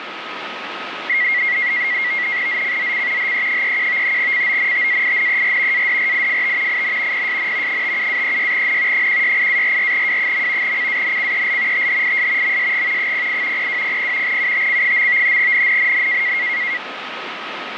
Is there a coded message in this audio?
Yes: NAVTEX (SITOR-B), 100 baud, 170 Hz shift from 1.1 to 16.8 s, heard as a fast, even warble, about 2050 Hz centre, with radio static and a steady whistle near 1270 Hz. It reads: ZCZC HE31 CONTAINER ADRIFT IN PSN 57-36N 168-44W. CANCEL THIS MSG 08 0200 UTC. NNNN